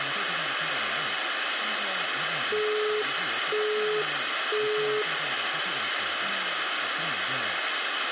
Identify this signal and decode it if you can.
Telephone call progress tone (single-tone plan, as in Europe, Japan and elsewhere), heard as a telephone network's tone, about 420 Hz, 0.5 s on and 0.5 s off, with phone line noise, room echo and speech in Korean. Busy tone.